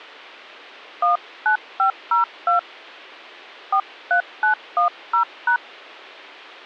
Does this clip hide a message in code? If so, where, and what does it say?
Yes: DTMF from 1.0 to 5.6 s, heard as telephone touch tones, dialled by hand, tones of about 110 ms. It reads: 19502 43910#